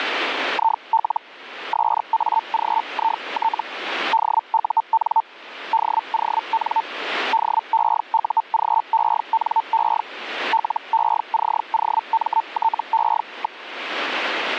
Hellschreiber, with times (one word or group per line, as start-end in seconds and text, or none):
0.5-1.2 IL
1.7-3.6 SAGIT
4.1-5.2 DUN
5.7-6.8 DON
7.3-10.0 DEUGENE
10.5-13.6 LECOMTE.